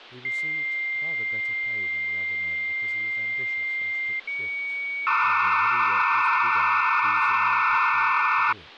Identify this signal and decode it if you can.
Dial-up modem handshake (low-speed, two carriers), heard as two whistles, then hiss, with phone line noise and speech in English.